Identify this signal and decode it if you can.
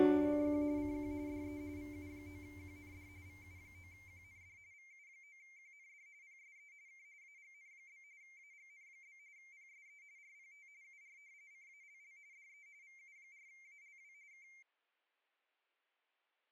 RTTY (45.45 baud, 170 Hz shift), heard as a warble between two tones, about 2200 Hz centre. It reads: … CQ CQ DE VU9QND VU9QND VU9QND PSE K AGN? AGN? PSE RPT UR CALL DE VU4ALW K